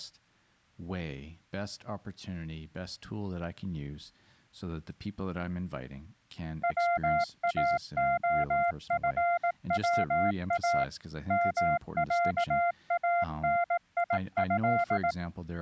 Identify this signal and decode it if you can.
Morse code (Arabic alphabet), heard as a keyed tone, machine-sent, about 18 wpm, 690 Hz, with speech in English. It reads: واخفوا معانيه